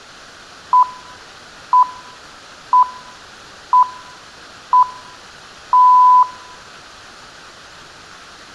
Radio time signal (six pips, as the Greenwich Time Signal), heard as pips.